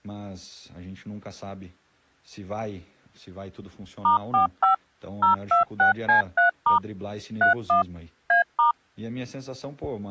DTMF, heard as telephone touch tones, dialled by machine, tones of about 120 ms. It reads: *45 026C3* 31 A*